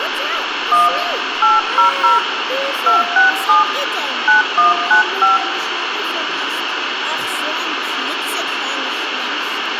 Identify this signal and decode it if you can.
DTMF, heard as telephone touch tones, dialled by hand, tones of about 150 ms, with radio hiss and room echo. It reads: 1 800 267 9195